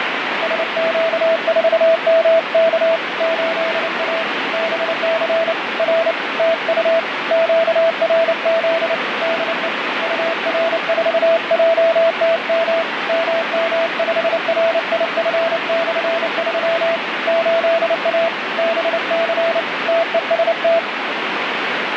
Morse code, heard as a keyed tone, hand-sent with a paddle, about 29 wpm, 660 Hz, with heavy radio static. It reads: SQ4MK 8A BC R TU QRZ DE UR4JTM MM5RIF/3 8A BC TEST